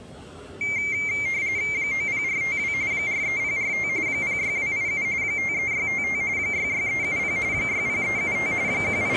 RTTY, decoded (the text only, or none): 90452 43045 06287 53655 66370 60375 …